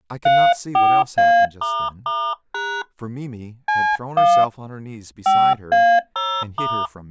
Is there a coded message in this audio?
Yes: DTMF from 0.3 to 6.9 s, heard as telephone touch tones, dialled by hand, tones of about 280 ms, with speech in English. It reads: 34A**# C1 5A0*